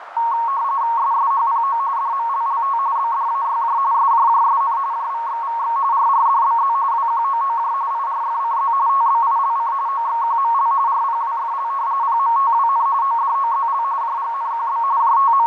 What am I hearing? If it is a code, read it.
RTTY (45.45 baud, 170 Hz shift), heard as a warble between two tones, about 1010 Hz centre, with radio static, fading and a narrow filter. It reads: SSHPO DMLLT BDAYJ SJJSN JVXVX RRDBZ WQOOJ IRFCZ TBILC OXQML RPWFL PMTWN ODOZL JGNQB …